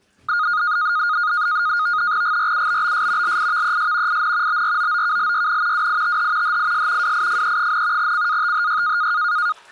NAVTEX (SITOR-B), 100 baud, 170 Hz shift, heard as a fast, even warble, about 1340 Hz centre, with the noise of a restroom. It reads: GRUBBS LIVES IN BROOKLYN WITH HIS WIFE, CATHY